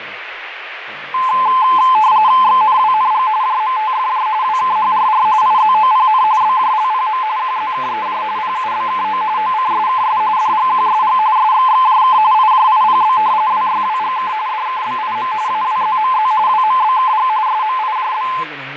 RTTY (45.45 baud, 170 Hz shift), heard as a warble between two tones, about 950 Hz centre, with radio static, fading and speech in English. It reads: XNWNG JMTFJ WKHRR IZOPN BJLPM QZKEJ PUBKO OCSKS DGQSG SXXJK IJIPB WYWGK DKBIM AWZMZ WMBKG SMIJB